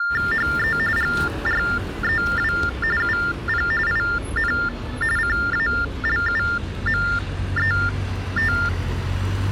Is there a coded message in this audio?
Yes: TTY/TDD text telephone tones (45.45 baud Baudot) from 0.0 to 8.7 s, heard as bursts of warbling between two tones, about 400 Hz shift, 1600 Hz centre, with street noise. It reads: HE GREW UP IN CALUMET